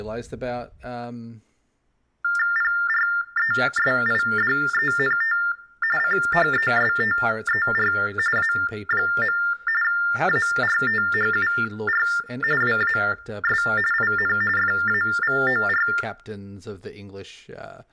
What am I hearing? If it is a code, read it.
TTY/TDD text telephone tones (45.45 baud Baudot), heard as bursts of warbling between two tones, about 400 Hz shift, 1600 Hz centre, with room echo and speech in English. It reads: PRESIDENT CHESTER A. ARTHUR WAS IN FAVOR